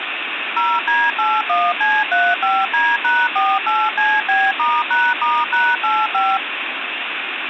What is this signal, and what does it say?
DTMF, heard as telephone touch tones, dialled by machine, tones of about 230 ms, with phone line noise. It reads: 0D81C35D#48CB*#*#85